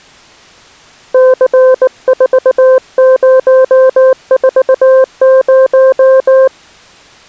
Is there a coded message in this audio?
Yes: Morse code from 1.1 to 6.5 s, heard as a keyed tone, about 19 wpm, 520 Hz. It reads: C4040